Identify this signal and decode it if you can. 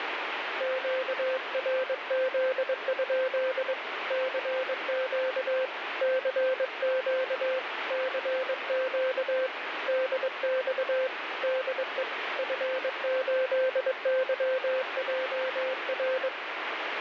Morse code, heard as a keyed tone, hand-sent with a paddle, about 22 wpm, 520 Hz, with radio static. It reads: QRZ? CQ CQ CQ DX DE F8YJR